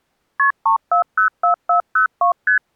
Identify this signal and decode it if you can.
Multi-frequency trunk signalling (R1, as on North American trunks), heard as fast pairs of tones, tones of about 110 ms. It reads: KP 3404402 ST